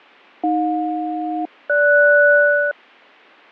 Aircraft SELCAL, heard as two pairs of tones, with fading. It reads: AJ-GS